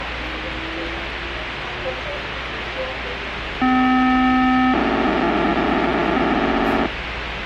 POCSAG pager data (512 baud), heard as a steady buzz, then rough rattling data, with radio hiss and the noise inside a subway train.